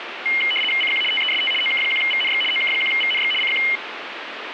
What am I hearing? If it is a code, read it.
RTTY (75 baud, 850 Hz shift), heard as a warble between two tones, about 2550 Hz centre, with radio static. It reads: CQ TEST OK1VNX OK1VNX CQ